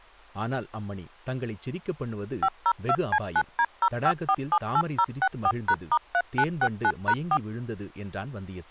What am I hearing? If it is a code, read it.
DTMF, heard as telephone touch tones, dialled by machine, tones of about 60 ms, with speech in Tamil. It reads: 502C9D05478064#*3969#4